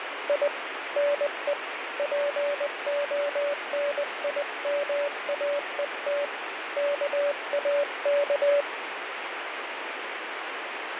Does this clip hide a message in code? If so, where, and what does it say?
Yes: Morse code (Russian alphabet) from 0.2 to 8.7 s, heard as a keyed tone, hand-sent with a paddle, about 20 wpm, 580 Hz, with radio static. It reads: И НЕ ПОНИМАЕТ КАК